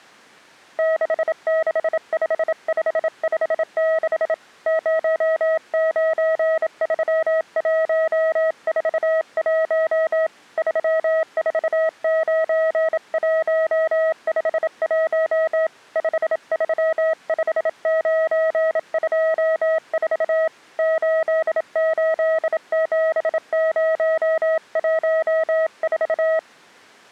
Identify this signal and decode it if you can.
Morse code, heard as a keyed tone, hand-sent with a bug key, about 27 wpm, 640 Hz. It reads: 665556 093141 349151 535924 887014